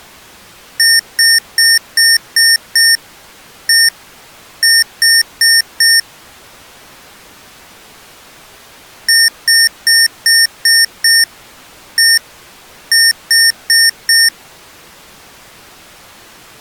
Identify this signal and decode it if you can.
Beep code, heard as beeps from a small speaker, played twice, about 1800 Hz. 6-1-4.